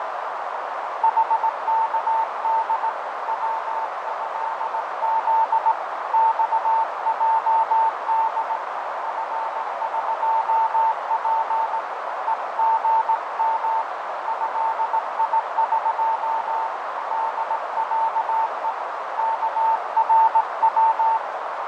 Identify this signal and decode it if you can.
Morse code (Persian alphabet), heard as a keyed tone, hand-sent with a straight key, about 18 wpm, 900 Hz, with heavy radio static, fading and a narrow filter. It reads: حکد وضز خجد فقپ هژم ضیق دصه کرو